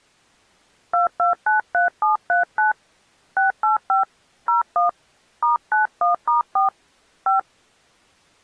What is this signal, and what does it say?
DTMF, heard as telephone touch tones, dialled by hand, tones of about 140 ms. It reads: 2293739 685 01 *91*4 5